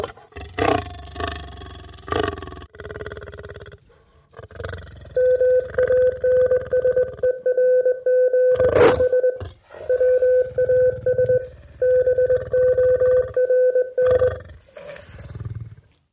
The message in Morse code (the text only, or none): MANSERGH WAS BORN